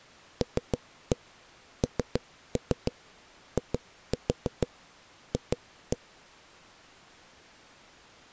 Tap code, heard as knocks on a wall, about 6 knocks a second. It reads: LNIF